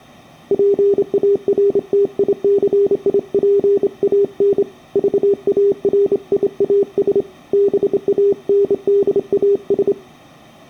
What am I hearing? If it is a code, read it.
Morse code, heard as a keyed tone, hand-sent with a straight key, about 27 wpm, 400 Hz. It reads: PARTICIPAN VARIAS BANDAS